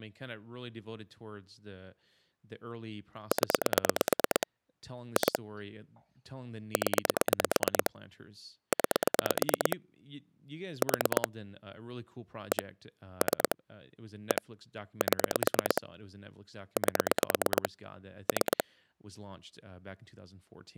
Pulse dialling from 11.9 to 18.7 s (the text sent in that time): 1 3 1 7 8 3